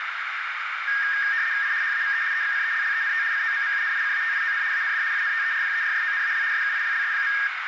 RTTY (75 baud, 170 Hz shift), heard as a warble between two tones, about 1750 Hz centre, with radio static and a narrow filter. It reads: I HAVE EXCELLENT COMMUNICATION AND INTERPERSONAL SKILLS.